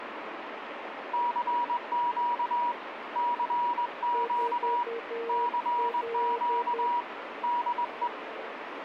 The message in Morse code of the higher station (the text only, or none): CQ CQ CQ DE